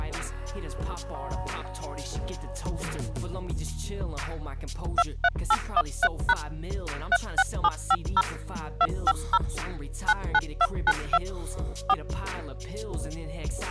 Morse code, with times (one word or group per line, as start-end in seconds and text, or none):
none